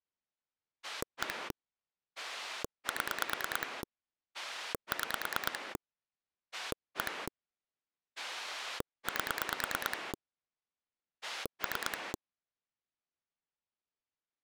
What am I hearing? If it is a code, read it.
Pulse dialling, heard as a rotary dial, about 9 pulses a second. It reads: 1 7 6 1 8 3